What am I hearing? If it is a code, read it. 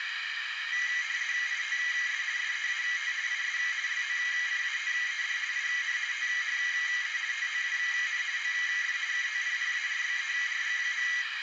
RTTY (50 baud, 170 Hz shift), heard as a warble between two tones, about 2050 Hz centre, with radio static and a narrow filter. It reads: ITS SEAT IS LOCATED IN THE TOWN OF KOPPARBERG.